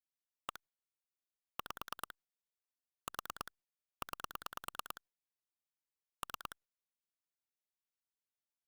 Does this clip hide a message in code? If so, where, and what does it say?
Yes: pulse dialling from 0.5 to 6.5 s, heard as clicks on a phone line, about 9 pulses a second. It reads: 1 5 4 9 3